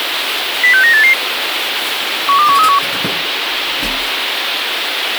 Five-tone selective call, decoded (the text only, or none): 06988 12131